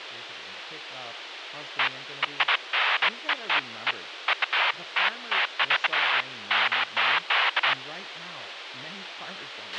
Bursts of noise, with radio hiss, a squelch burst at the end and speech in English. There is no code.